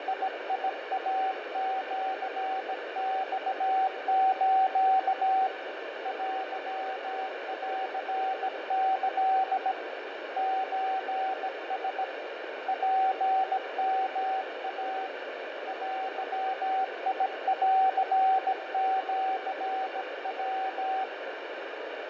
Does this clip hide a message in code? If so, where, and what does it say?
Yes: Morse code (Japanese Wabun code) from 0.0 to 21.1 s, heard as a keyed tone, hand-sent with a bug key, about 17 wpm, 760 Hz, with heavy radio static and fading. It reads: … テンキ ソラ ツヨイ デンシヤ